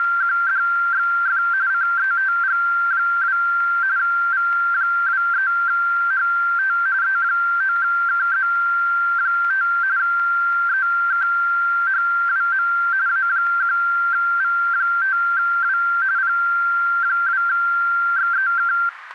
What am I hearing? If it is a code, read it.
RTTY (45.45 baud, 170 Hz shift), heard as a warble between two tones, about 1470 Hz centre, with radio static. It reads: … CETG2 V23HT E9KZ5 EKHWM A1V5W P2XEK